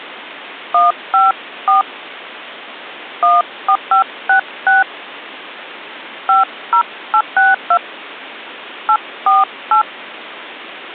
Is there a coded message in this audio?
Yes: DTMF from 0.7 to 9.8 s, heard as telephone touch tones, dialled by hand, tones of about 130 ms. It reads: 154 14566 50862 848